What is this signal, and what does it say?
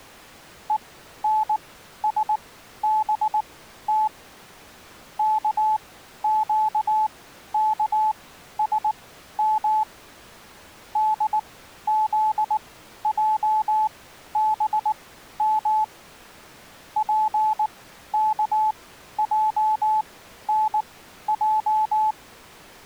Morse code (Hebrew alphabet), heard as a keyed tone, machine-sent, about 19 wpm, spaced as for 12 wpm, 860 Hz. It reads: ונשבת כקכשם דזעבם פכענע